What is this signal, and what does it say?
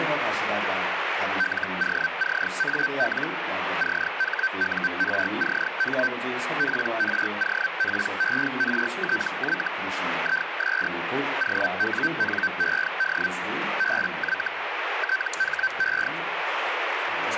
Hellschreiber (Feld-Hell, 122.5 baud), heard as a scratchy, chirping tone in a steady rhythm, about 1550 Hz, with radio static. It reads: LOCAL CHURCH PROPERTY IS OWNED BY THE